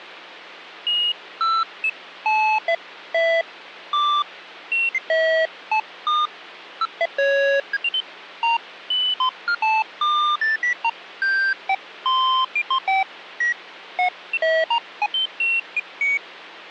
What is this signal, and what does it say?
Electronic bleeps of random pitch and length, with phone line noise. There is no code.